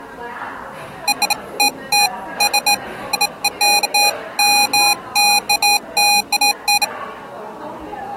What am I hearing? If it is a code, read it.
Beeps of irregular length, with the noise of a cafe. There is no code.